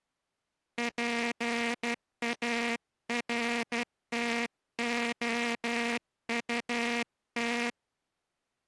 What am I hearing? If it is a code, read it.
Morse code, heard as a buzzer, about 12 wpm. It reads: PARTOUT